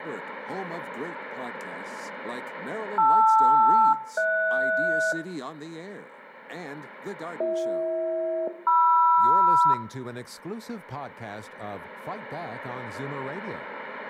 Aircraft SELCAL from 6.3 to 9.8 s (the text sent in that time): BH-MR